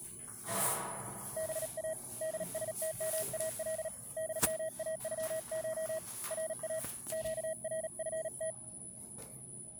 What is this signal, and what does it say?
Morse code (Persian alphabet), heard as a keyed tone, hand-sent with a paddle, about 37 wpm, 640 Hz, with the noise inside a lift. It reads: با دستمال دماغش را گرفت